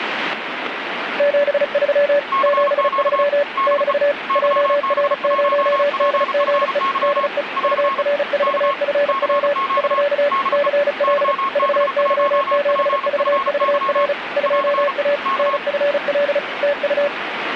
Morse code, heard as two keyed tones, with radio static. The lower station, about 35 wpm, 580 Hz: 73 73 <BT> JR0DGE DE UR4FW <SK> CL VY7VVR 2A NFL TU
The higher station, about 35 wpm, 1090 Hz: CQ DE YB1PFY <AR> K CQ DE YB1PFY <AR> K